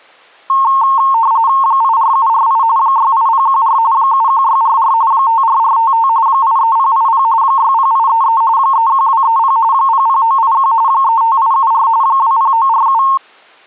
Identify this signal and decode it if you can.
RTTY (45.45 baud, 170 Hz shift), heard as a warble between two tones, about 990 Hz centre. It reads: 84748 68014 71644 54455 83080 60833 31230 00981 35874 20947